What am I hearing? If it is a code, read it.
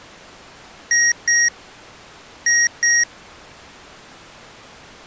Beep code, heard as beeps from a small speaker, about 1900 Hz. 2-2.